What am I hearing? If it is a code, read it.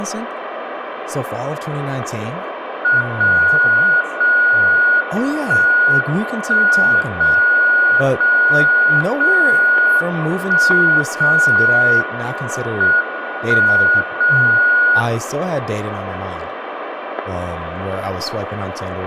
Radio time signal (WWVB), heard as a tone whose level steps once a second, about 1450 Hz, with room echo and speech in English. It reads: 0 0 1 1 0 0 0 1 0 M 1 0